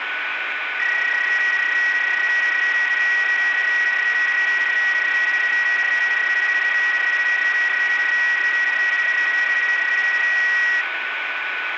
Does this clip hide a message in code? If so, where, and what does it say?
Yes: PSK31 (31.25 baud) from 0.8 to 10.8 s, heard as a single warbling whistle, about 1900 Hz, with radio static and a steady whistle near 1490 Hz.